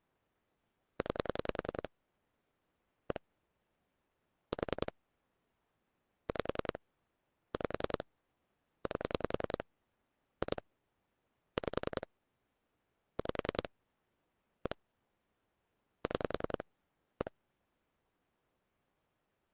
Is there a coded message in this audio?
Yes: pulse dialling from 1.0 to 17.3 s, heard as clicks on a phone line, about 10 pulses a second. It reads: 9 1 4 5 5 8 2 5 5 1 6 1